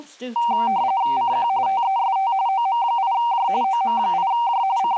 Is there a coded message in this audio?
Yes: RTTY (45.45 baud, 170 Hz shift) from 0.4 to 5.0 s, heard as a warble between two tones, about 860 Hz centre, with speech in English. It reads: CQ TEST OM8J OM8J …